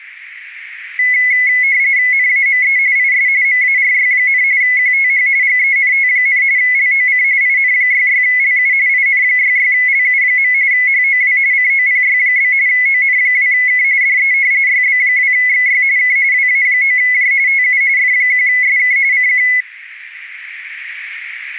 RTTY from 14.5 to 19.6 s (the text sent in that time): YB2XY K WA9J TU F1SK CQ